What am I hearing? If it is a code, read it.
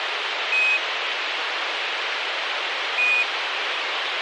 Quindar tones, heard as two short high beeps, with radio hiss.